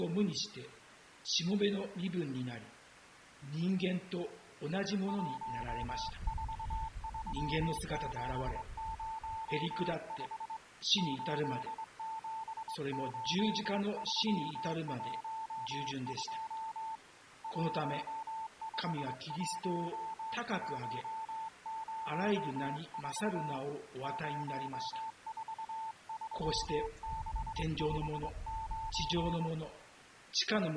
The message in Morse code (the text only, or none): 143705 878312 151104 043659